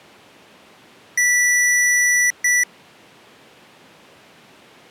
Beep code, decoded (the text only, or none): 1 long, 1 short